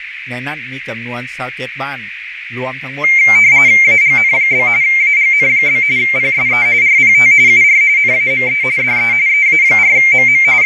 RTTY (45.45 baud, 170 Hz shift), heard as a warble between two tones, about 2200 Hz centre, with radio static, fading and a narrow filter. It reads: AGN? AGN? PSE RPT UR NAME DE EA4MM …